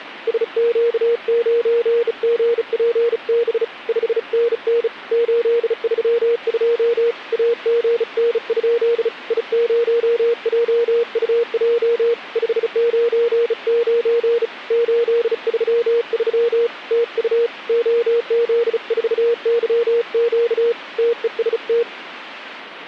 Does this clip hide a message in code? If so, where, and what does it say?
Yes: Morse code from 0.2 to 21.9 s, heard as a keyed tone, hand-sent with a bug key, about 35 wpm, 470 Hz. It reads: SQ9GPB 5NN 832 AGN? I0JUJ 599 833 TU OZ4YQ TEST